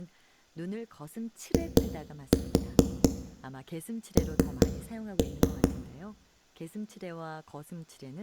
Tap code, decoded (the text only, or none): IN